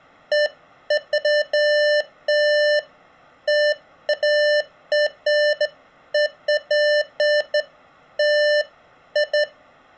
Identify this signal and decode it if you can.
Beeps of irregular length. There is no code.